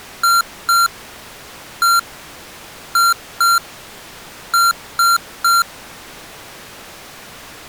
Beep code, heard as beeps from a small speaker, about 1380 Hz. 2-1-2-3. In Phoenix BIOS tables: ROM copyright notice check failure.